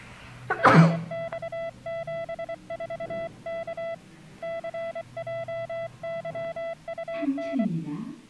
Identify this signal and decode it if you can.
Morse code, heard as a keyed tone, hand-sent with a paddle, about 24 wpm, 670 Hz, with the noise inside a lift. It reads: RX74K CJYUN